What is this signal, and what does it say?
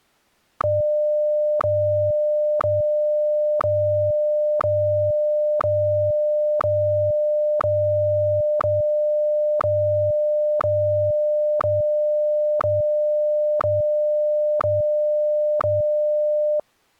Radio time signal (WWVH, Hawaii), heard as ticks, one a second.